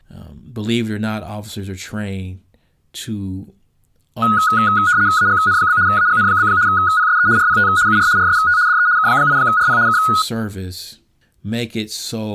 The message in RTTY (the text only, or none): AGN? AGN? PSE RPT UR RST DE K8RP K